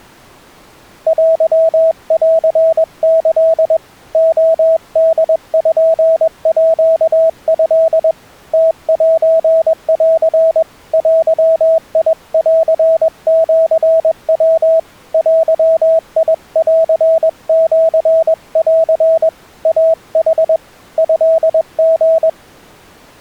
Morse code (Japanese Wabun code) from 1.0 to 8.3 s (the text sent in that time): テンキ レポート